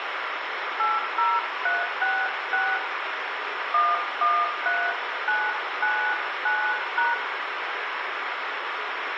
DTMF, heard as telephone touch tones, dialled by hand, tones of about 240 ms, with radio hiss and room echo. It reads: 80366 113999#